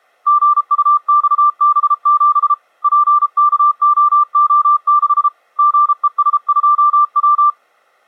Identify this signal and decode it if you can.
Morse code, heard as a keyed tone, hand-sent with a paddle, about 33 wpm, 1180 Hz. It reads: GUXB7 PKOO6 GES2W